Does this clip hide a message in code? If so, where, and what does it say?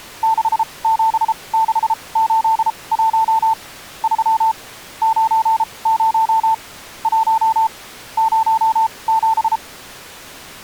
Yes: Morse code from 0.2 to 9.6 s, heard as a keyed tone, machine-sent, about 33 wpm, spaced as for 24 wpm, 890 Hz. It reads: 67681 3 90 1 07